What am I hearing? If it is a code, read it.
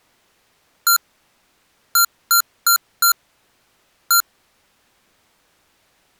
Beep code, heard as beeps from a small speaker, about 1380 Hz. 1-4-1. In Phoenix BIOS tables: address line failure in the first 64 KB of memory.